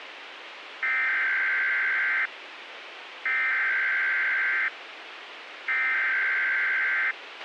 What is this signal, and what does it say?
Emergency Alert System (SAME) tones (header bursts), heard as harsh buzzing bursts, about 520.83 baud, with radio hiss and a squelch burst at the end.